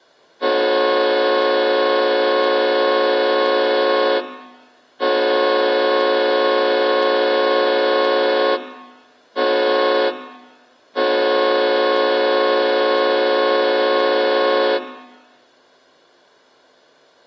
Train horn signal, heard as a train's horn, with room echo. 2 long, 1 short, 1 long. On North American railways: approaching a public crossing.